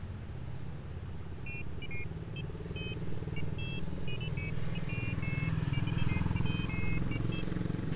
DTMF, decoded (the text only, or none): none